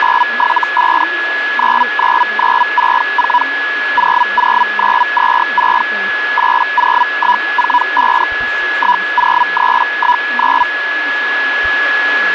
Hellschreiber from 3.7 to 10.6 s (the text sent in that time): 00926 80145 10319